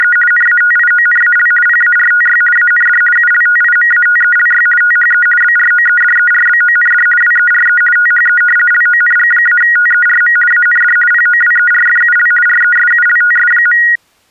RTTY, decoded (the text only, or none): … NATIONAL PARTY AND ULTIMATELY THE BROEDERBOND WERE THE LONG-TERM AND POWERFUL RESULTS.